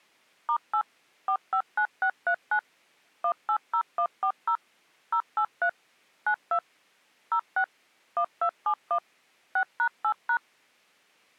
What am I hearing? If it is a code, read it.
DTMF, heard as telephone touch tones, dialled by machine, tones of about 80 ms. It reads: *8 459639 180140 083 92 06 1271 6#8#